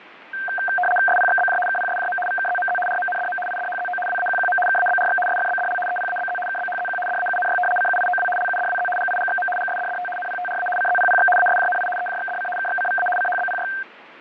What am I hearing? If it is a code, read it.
RTTY (75 baud, 850 Hz shift), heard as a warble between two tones, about 1140 Hz centre, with radio static and fading. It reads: SPXBJ KPSJM VKZMZ RMNDM IDHZO WAQQM KABRX SFBDL EPABZ KBHZQ DAUNY CUIOW LUDWZ GIGXM GSDDT NPTRA CZPPX ASJNI EJXDC KXCVA CHBPY